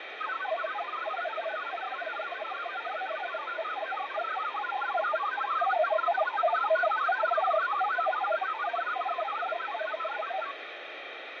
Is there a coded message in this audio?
Yes: multi-tone FSK (Olivia or MFSK type), about 1000 Hz wide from 0.2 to 10.5 s, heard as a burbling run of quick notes, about 62.5 baud, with radio static and fading.